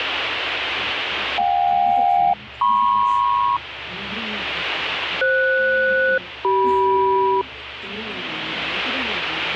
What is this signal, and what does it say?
Aircraft SELCAL, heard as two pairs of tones, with radio static and the noise of a cafe. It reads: JK-MP FS-CM